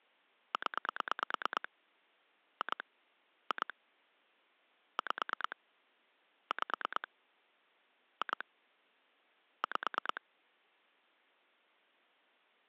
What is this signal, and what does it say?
Pulse dialling, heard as clicks on a phone line, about 9 pulses a second. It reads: 0 2 2 5 5 2 5